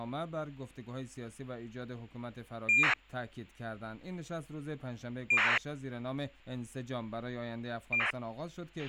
ACARS aircraft data, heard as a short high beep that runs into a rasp, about 2400 baud, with a squelch burst at the end.